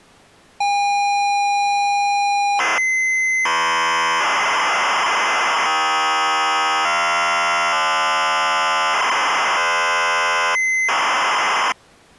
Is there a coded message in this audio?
Yes: ZX Spectrum tape loading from 0.6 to 11.7 s, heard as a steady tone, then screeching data.